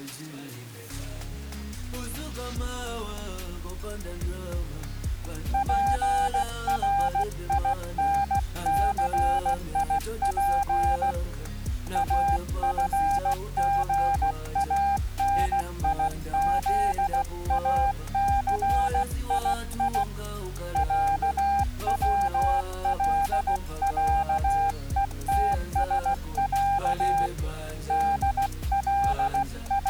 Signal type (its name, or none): Morse code